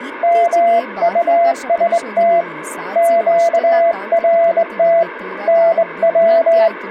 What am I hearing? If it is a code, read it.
Morse code, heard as a keyed tone, hand-sent with a straight key, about 21 wpm, 680 Hz, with speech in Kannada. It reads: MUST QRT NW